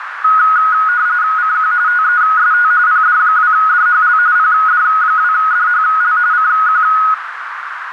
RTTY (45.45 baud, 170 Hz shift), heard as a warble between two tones, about 1360 Hz centre, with radio static and a narrow filter. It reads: CQ TEST PD2DHL PD2DHL CQ